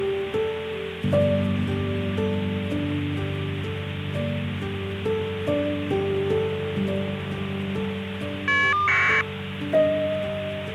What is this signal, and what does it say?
Caller ID data burst, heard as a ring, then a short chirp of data, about 1200 baud, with phone line noise.